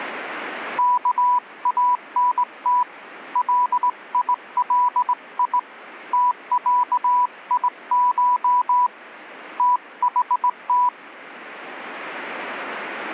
Morse code (Arabic alphabet), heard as a keyed tone, hand-sent with a straight key, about 18 wpm, 990 Hz. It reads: كانت ليلي تعيش تحت